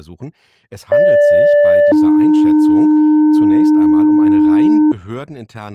Two-tone page, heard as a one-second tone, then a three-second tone, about 580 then 300 Hz.